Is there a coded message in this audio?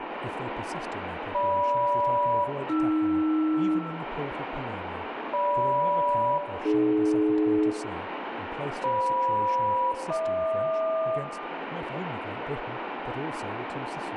Yes: aircraft SELCAL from 1.3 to 11.2 s, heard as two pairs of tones, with radio static, room echo and speech in English. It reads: GM-AR GM-AD FM-HQ